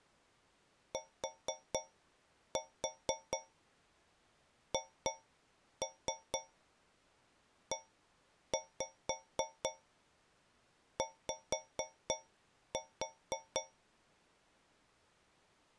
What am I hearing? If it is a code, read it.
Tap code, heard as taps on a metal pipe, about 4 knocks a second. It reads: THEY